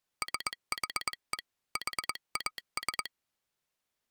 Morse code (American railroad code), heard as a telegraph sounder. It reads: SHE HAS